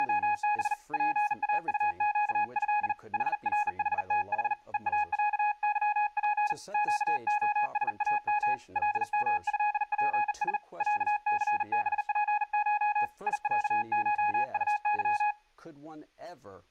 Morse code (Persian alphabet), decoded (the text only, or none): … پاطگض حرحتح هاصظپ گعسام لمضپس صثبپش یصشطظ